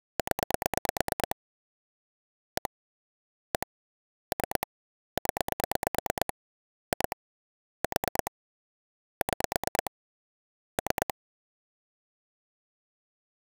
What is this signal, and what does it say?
Pulse dialling, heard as clicks on a phone line, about 9 pulses a second. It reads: 0 1 1 3 0 2 4 6 3